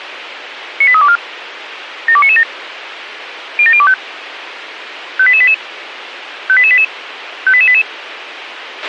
Five-tone selective call (ZVEI), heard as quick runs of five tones, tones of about 70 ms, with radio hiss and a squelch burst at the end. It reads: 98324 72997 07025 58888 58888 58888